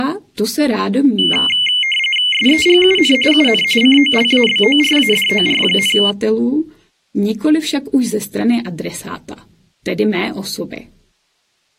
RTTY (45.45 baud, 850 Hz shift), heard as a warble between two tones, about 2550 Hz centre. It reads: SEGUN UN COLABORADOR,